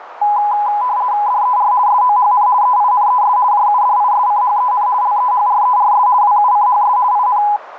RTTY (50 baud, 170 Hz shift), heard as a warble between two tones, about 910 Hz centre, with radio static and a narrow filter. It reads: DER SOHN EINES JUDISCHEN LEHRERS WUCHS IN